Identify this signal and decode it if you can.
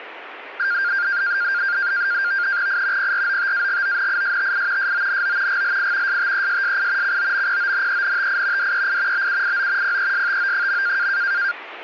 NAVTEX (SITOR-B), 100 baud, 170 Hz shift, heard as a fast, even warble, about 1500 Hz centre, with radio static. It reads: I PROTAGONISTI SONO GLI STESSI COMPONENTI DEI BUIO PESTO.